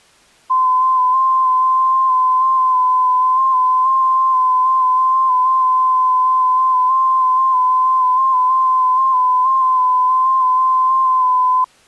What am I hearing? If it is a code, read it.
FT8 (one signal), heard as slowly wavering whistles, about 6.25 baud.